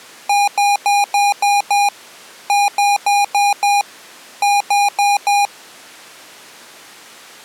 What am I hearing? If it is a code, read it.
Beep code, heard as beeps from a small speaker, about 810 Hz. 6-5-4.